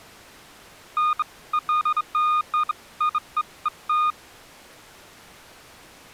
Beeps of irregular length. There is no code.